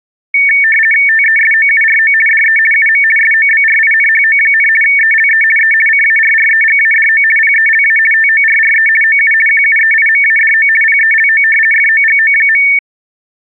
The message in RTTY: TESOURO DE UM SOBRINHO, ELE E CARREGADO PELA TORRE OU QUEIMADO PELO FOGO.

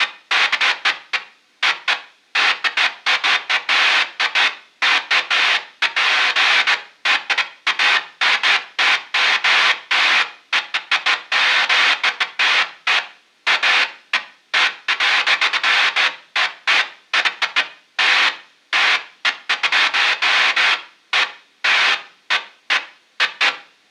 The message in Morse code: none

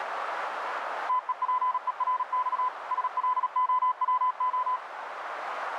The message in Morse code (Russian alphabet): ТЕПЕРЬ СЛОВО

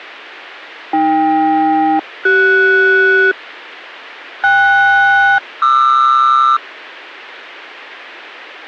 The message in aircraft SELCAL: AK-CS KS-QR

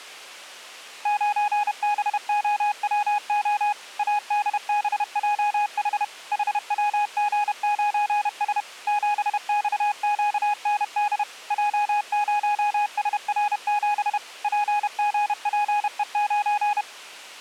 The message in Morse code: 9BOWO ADBJH HWG9S 7XQND J0SR7 PGPE9

